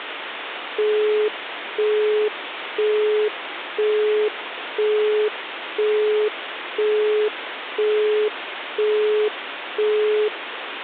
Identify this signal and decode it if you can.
Telephone call progress tone (single-tone plan, as in Europe, Japan and elsewhere), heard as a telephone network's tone, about 420 Hz, 0.5 s on and 0.5 s off, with phone line noise. Busy tone.